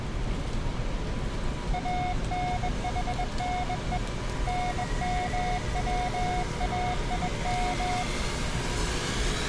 Morse code (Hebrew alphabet), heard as a keyed tone, hand-sent with a bug key, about 21 wpm, 720 Hz, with street noise. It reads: אנחנו נמצאים